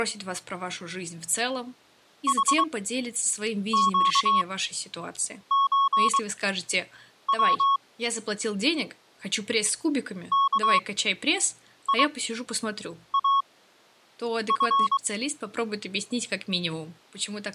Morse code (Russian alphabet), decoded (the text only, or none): ХЩЧВ КИАФ